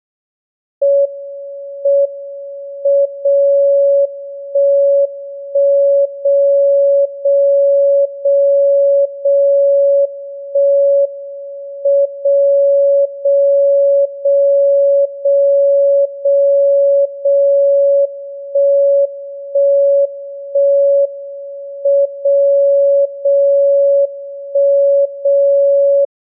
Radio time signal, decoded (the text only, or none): M M 0 1 1 0 0 0 0 1 M 0 0 0 0 0 0 1 1 1 M 0 0 1 0